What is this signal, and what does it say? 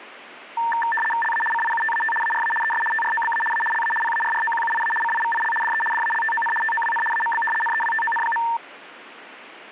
RTTY (75 baud, 850 Hz shift), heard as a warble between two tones, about 1350 Hz centre. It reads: LA CIUTAT ARA ES TROBA A LA PARROQUIA CIVIL DE DALTON TOWN AMB NEWTON.